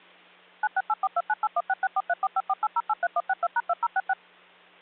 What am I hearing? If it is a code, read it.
DTMF, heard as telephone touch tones, dialled by machine, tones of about 40 ms, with hum. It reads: 9684298166434548083162#2066